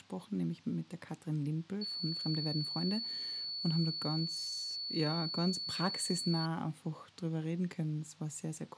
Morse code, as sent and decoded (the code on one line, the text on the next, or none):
none